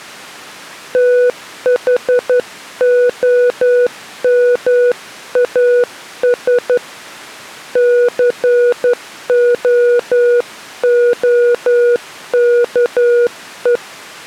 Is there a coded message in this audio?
Yes: Morse code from 0.9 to 13.8 s, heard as a keyed tone, hand-sent with a straight key, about 11 wpm, 490 Hz. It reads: THOMAS COOKE